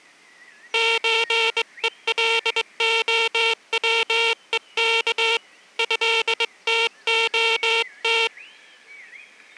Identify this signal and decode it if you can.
Morse code (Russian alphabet), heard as a buzzer, hand-sent with a straight key, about 22 wpm, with the noise of a park. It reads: ЧЕЛОВЕК ЭТОТ